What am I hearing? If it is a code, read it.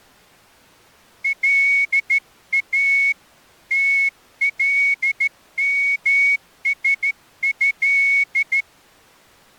Morse code (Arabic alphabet), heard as a whistle, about 13 wpm. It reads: لا تلمسه